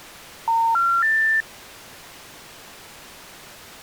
Telephone call progress tone (North American plan), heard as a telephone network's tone, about 910, 1370, 1800 Hz. Special information tone.